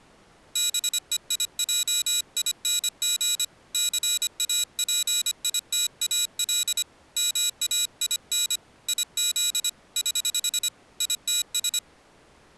Morse code, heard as a high beeper, hand-sent with a paddle, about 25 wpm, 3900 Hz. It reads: BEIJING CAPITAL MAIN IZ <HH> ITS